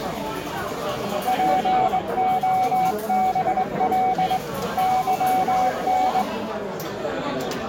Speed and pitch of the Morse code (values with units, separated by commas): 21 wpm, 750 Hz